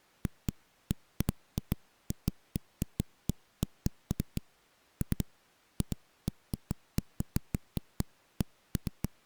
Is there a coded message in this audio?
No, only irregular knocks on a wall.